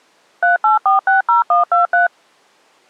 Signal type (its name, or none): DTMF